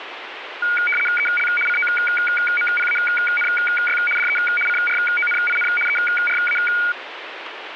RTTY (75 baud, 850 Hz shift), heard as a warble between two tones, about 1850 Hz centre, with radio static. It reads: EL COMPANY DE CRONIN ERA